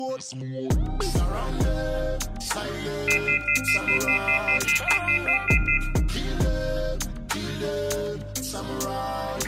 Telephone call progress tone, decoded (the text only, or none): off-hook warning tone